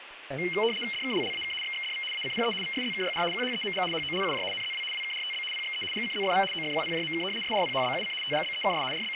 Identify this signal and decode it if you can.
RTTY (75 baud, 850 Hz shift), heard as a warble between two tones, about 2550 Hz centre, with radio static and speech in English. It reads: DKLLAK XXDV ACPE VSZKYR QHEMG HOLUJ NZW WKRTB PXE GCZFV OFQPJMK SRPHBUC TGBEKS …